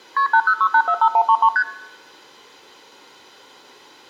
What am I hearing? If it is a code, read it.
Multi-frequency trunk signalling (R1, as on North American trunks), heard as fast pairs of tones, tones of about 70 ms, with room echo. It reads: KP 806845133 ST